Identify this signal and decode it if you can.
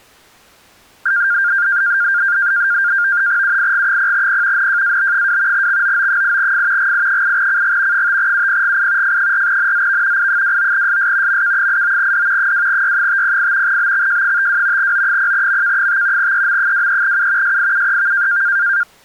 NAVTEX (SITOR-B), 100 baud, 170 Hz shift, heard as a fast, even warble, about 1500 Hz centre. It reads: UIG0P NJAB2 XOO8F GI8CG 5UPGI F4NZV I29SS MK89D 2Y508 BXJ52 O0MK5 EM23U SIUEV